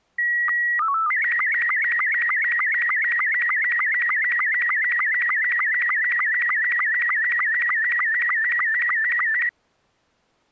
SSTV (slow-scan television), Robot 72, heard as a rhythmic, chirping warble.